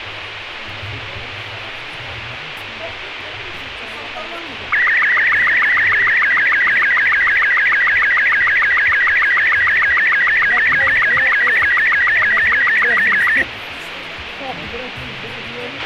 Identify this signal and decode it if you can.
SSTV (slow-scan television), Robot 36, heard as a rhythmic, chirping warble, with radio hiss and a squelch burst at the end.